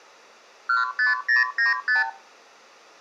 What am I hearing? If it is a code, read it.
Multi-frequency trunk signalling (R2, with the far end's replies), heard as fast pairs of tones, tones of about 150 ms, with room echo. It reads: 15095